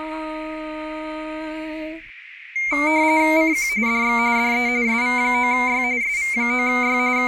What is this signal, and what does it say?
RTTY (45.45 baud, 170 Hz shift), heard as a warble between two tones, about 2200 Hz centre, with radio static. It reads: CQ DX DE SV9Y SV9Y …